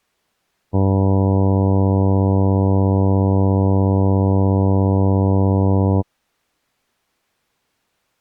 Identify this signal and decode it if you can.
Ship horn signal, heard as a ship's horn, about 100 Hz. 1 long. At sea: a vessel nearing a blind bend, or under power and making way in fog.